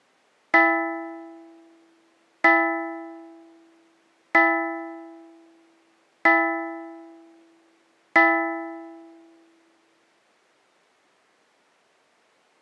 Clock strike, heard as a bell. 5. Five o'clock.